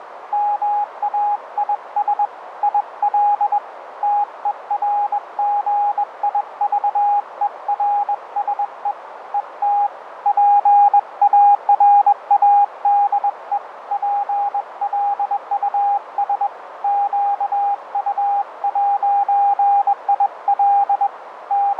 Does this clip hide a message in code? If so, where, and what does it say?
Yes: Morse code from 0.3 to 21.8 s, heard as a keyed tone, hand-sent with a bug key, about 21 wpm, 820 Hz, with radio static, fading and a narrow filter. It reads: MAIS IL TERGIVERSE ET PARADE PLUS QU'IL …